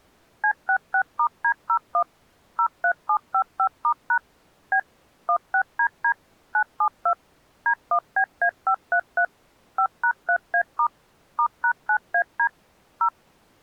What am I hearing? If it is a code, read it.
DTMF, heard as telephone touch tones, dialled by machine, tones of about 80 ms. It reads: C66*D01 03755*# B 16DD 972 D1BA533 5#3A* *#9AD 0